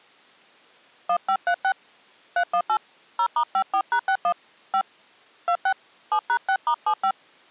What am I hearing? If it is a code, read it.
DTMF, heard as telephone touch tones, dialled by hand, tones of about 80 ms. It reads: 1536 318 0*54#61 5 26 7#6*75